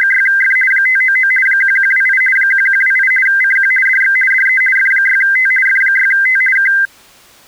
RTTY (50 baud, 450 Hz shift), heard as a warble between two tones, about 1800 Hz centre. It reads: … 599 1128 1128 CQ DX DE F6T F6T K